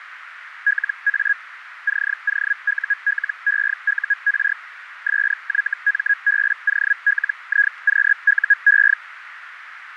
Hellschreiber (Feld-Hell, 122.5 baud), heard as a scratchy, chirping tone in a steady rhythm, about 1650 Hz, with radio static and a narrow filter. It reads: LA COULEUR SYMBOLIQUE